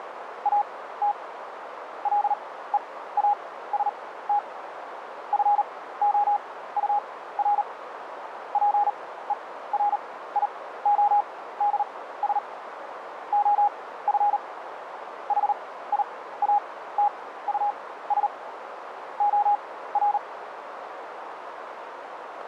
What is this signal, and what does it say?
Morse code, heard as a keyed tone, machine-sent, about 38 wpm, spaced as for 17 wpm, 820 Hz, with radio static and a narrow filter. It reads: AT LEAST FOUR PERIODS OF HIATUS OR